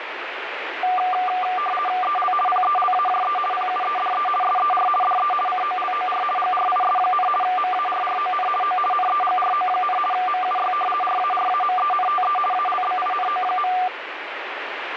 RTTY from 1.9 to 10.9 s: EL PELAJE PUEDE SER DE COLOR GRIS, MARRON O NEGRO, MUY

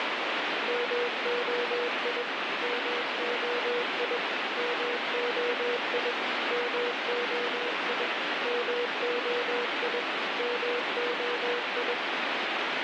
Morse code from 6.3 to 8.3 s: MOI

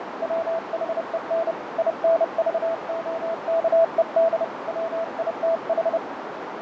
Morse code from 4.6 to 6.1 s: WITH

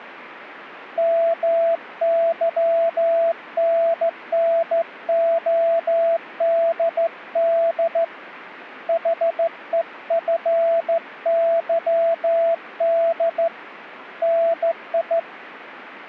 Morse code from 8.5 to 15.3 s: HEFYD NI

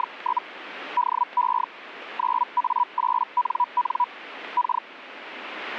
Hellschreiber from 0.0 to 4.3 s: … DE 9A8NN

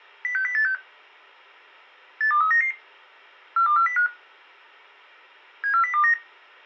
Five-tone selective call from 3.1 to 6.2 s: 42405 74029

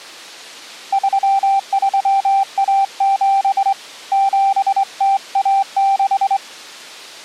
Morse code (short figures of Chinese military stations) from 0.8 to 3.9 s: 3317

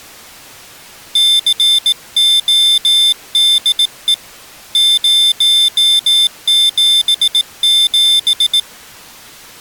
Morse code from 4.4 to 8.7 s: 077

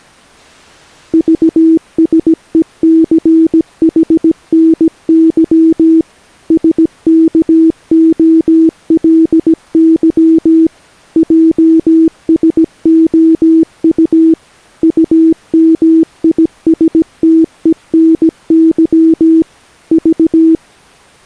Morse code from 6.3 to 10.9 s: SKOLY

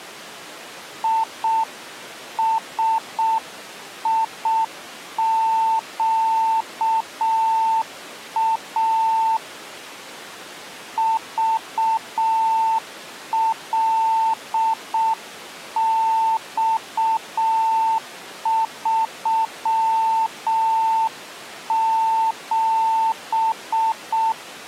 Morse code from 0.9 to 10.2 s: ISIQA

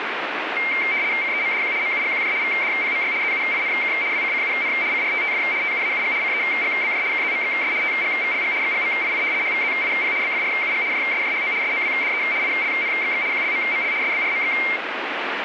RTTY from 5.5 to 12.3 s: TUAUG CEGBJ KZMXS TGVLG XGMII HVZIP BFRUG JSJHO SOWDE

